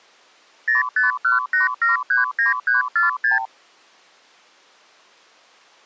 Multi-frequency trunk signalling (R2, with the far end's replies), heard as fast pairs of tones, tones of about 140 ms. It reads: 0518739346